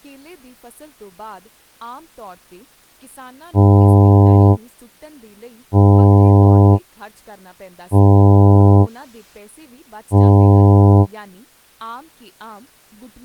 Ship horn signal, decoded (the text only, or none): 4 short